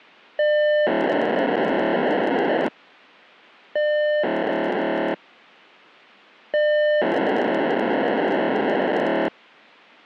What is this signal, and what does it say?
POCSAG pager data (1200 baud), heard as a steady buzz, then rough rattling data.